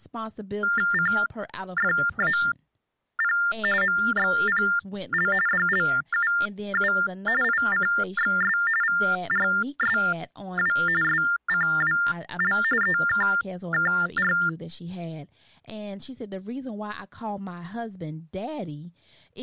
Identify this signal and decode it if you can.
TTY/TDD text telephone tones (45.45 baud Baudot), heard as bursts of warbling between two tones, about 400 Hz shift, 1600 Hz centre, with speech in English. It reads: CFAP MXPL DLUU ICXS VRSW SCWL EKKR